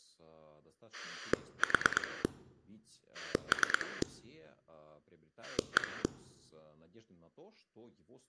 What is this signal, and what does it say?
Pulse dialling, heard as a rotary dial, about 9 pulses a second, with speech in Russian. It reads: 4 3 1